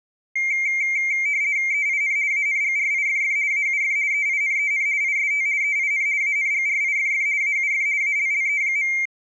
RTTY (50 baud, 170 Hz shift), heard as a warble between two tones, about 2200 Hz centre. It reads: EIN ANGRIFF AUF EINEN IST EIN ANGRIFF AUF ALLE.